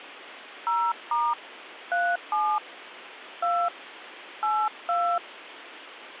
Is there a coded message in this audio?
Yes: DTMF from 0.7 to 5.2 s, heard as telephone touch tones, dialled by hand, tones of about 250 ms, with phone line noise. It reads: 0* 37 2 82